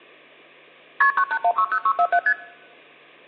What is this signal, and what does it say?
Multi-frequency trunk signalling (R1, as on North American trunks), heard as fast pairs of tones, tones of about 70 ms. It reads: KP 98160647 ST